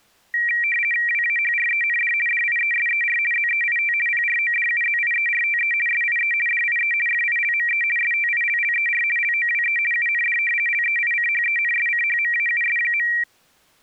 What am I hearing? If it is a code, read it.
RTTY (50 baud, 450 Hz shift), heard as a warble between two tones, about 2100 Hz centre. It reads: WAHREND DIESER ZEIT PRODUZIERTE SIE DIE FILME STILLER LOWE UND LEICHENSCHMAUS.